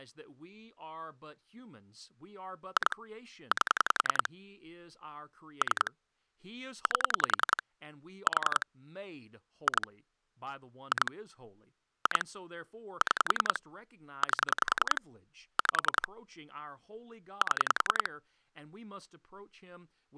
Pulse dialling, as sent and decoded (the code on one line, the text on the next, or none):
2 / 8 / 3 / 8 / 4 / 2 / 2 / 2 / 6 / 8 / 5 / 7
2 8 3 8 4 2 2 2 6 8 5 7